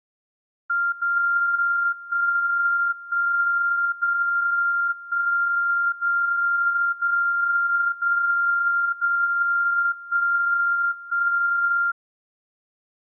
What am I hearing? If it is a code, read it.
Radio time signal (DCF77), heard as a tone whose level steps once a second, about 1390 Hz. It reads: 0 1 1 0 1 0 0 0 0 1 1